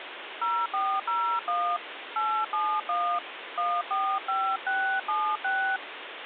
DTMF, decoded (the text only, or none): 0401 871 145676